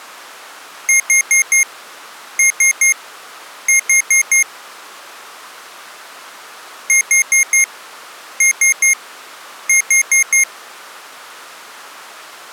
Beep code, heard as beeps from a small speaker, played twice, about 2150 Hz. 4-3-4. In Phoenix BIOS tables: time-of-day clock failure.